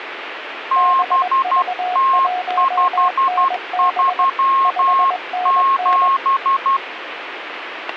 Morse code, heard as two keyed tones, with radio static. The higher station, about 12 wpm, 1070 Hz: BT537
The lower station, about 21 wpm, 730 Hz: BV1NB 5NN